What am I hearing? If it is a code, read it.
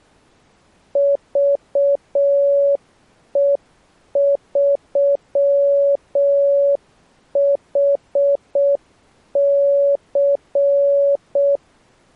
Morse code, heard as a keyed tone, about 6 wpm, 560 Hz. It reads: VE3HC